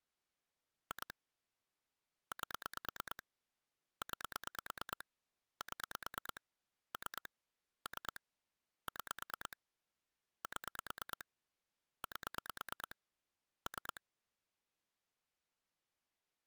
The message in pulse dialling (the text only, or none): 2 8 9 7 3 3 6 7 8 3